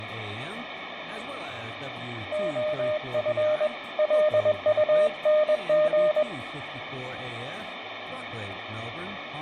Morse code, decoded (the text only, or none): OF LUNG